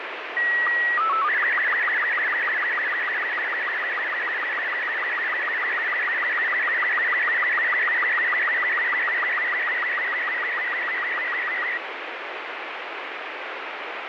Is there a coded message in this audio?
Yes: SSTV (slow-scan television), Robot 36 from 0.4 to 11.8 s, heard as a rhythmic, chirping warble, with radio static.